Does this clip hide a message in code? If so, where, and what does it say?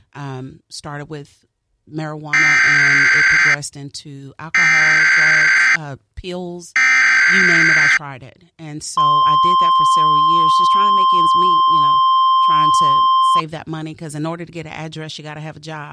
Yes: Emergency Alert System (SAME) tones (header bursts, then the 1050 Hz attention tone) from 2.3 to 13.4 s, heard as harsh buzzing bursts, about 520.83 baud, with speech in English.